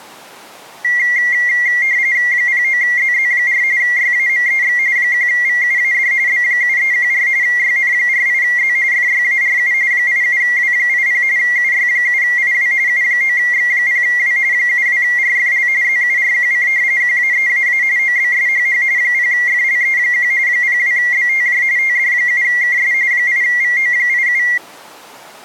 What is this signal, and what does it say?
RTTY (45.45 baud, 170 Hz shift), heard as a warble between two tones, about 2050 Hz centre. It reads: 09ZZ4 YAMEX 1VUAD B7314 YN48Z FYARU 87W80 UY7IW U9X0W 72RFL ZURQC QAEAA OBSHH 0FLE1 02BTJ TD7KS 8VO87